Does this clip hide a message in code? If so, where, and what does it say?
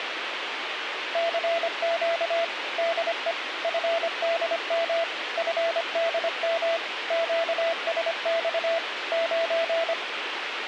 Yes: Morse code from 1.1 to 10.0 s, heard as a keyed tone, machine-sent, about 25 wpm, 670 Hz, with radio hiss. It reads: CQ DE FDM FDM QSX 9